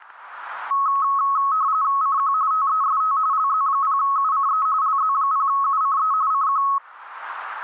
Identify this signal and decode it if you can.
RTTY (45.45 baud, 170 Hz shift), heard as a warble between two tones, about 1190 Hz centre, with static crashes. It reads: CQ TEST LZ0UCE LZ0UCE CQ